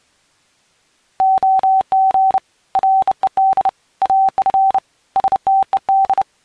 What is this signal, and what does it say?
Morse code, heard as a keyed tone, hand-sent with a bug key, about 30 wpm, 770 Hz. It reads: OG RED AF STED